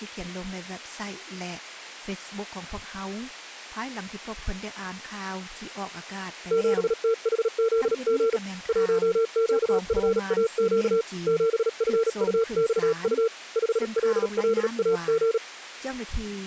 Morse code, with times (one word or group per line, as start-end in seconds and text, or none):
6.5-8.4 7THZG
8.7-11.0 1QFAQ
11.3-13.3 7FUXU
13.6-15.4 5LLAG